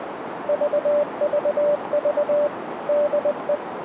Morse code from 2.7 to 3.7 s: DE

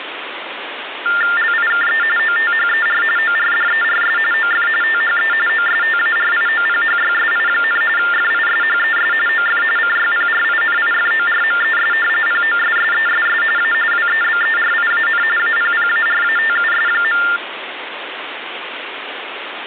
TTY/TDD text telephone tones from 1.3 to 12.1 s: LIKE OTHER ORDERS OF THE OSTARIOPHYSI, FISHES OF CYPRINIFORMES

